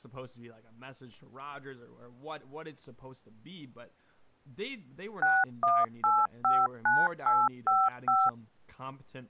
DTMF, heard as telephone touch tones, dialled by machine, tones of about 220 ms, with speech in English. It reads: 61859855